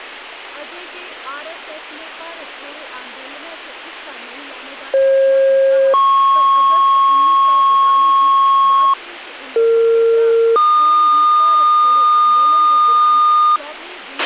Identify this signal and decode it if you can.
Two-tone page, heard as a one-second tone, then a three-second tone, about 540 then 1090 Hz, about 460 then 1220 Hz, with a squelch burst at the end and speech in Dogri.